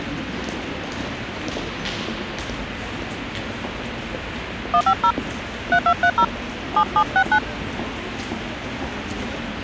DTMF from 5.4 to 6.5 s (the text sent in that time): 3230